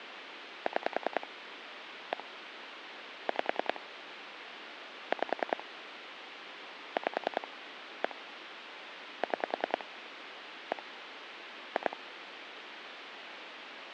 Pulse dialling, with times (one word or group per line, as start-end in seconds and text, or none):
0.7-1.3 6
2.1-2.2 1
3.3-3.8 5
5.1-5.6 5
7.0-7.5 5
8.0-8.1 1
9.2-9.8 6
10.7-10.8 1
11.8-12.0 2